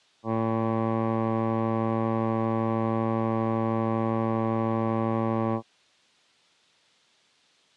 Ship horn signal, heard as a ship's horn, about 110 Hz. 1 long. At sea: a vessel nearing a blind bend, or under power and making way in fog.